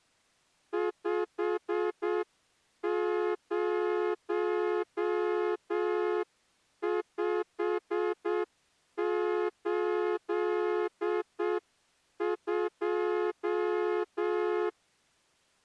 Morse code, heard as a horn, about 7 wpm. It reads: 50582